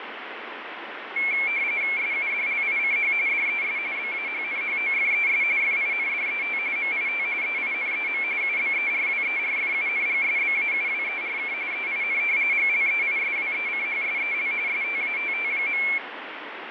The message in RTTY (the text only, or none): SUDLICH DES BAHNHOFES FINDET MIT EINEM UBERWERFUNGSBAUWERK EIN GLEISWECHSEL STATT.